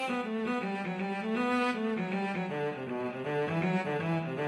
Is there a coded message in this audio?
No.